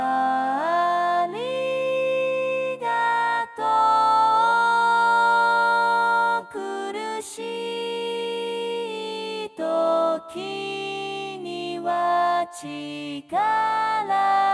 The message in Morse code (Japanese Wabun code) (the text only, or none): none